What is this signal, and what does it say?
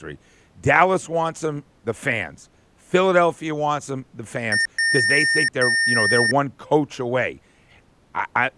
Beep code, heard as beeps from a small speaker, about 1800 Hz, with speech in English. 1 short, 2 long.